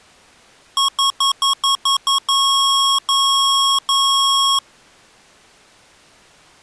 Beep code, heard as beeps from a small speaker, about 1100 Hz. 7 short, 3 long.